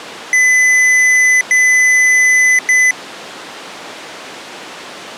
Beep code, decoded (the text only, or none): 2 long, 1 short